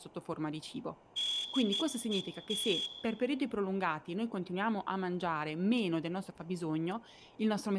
Morse code, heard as a whistle, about 14 wpm, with room echo and speech in Italian. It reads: DET